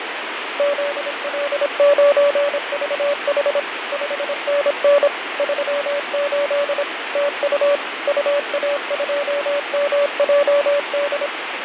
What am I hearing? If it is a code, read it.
Morse code, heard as a keyed tone, machine-sent, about 26 wpm, 570 Hz, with radio static and fading. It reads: ZL9VH 5NN 38 TU UA2MJD